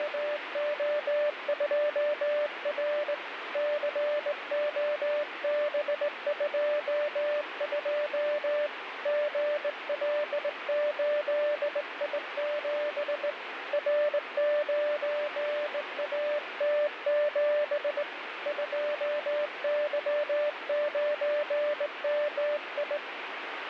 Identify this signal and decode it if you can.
Morse code, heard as a keyed tone, hand-sent with a straight key, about 19 wpm, 590 Hz, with radio static. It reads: … COB22 GL8I7 R9AT7 2Y9MI